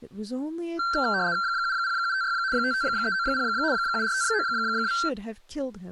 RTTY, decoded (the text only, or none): 70756 55390 74592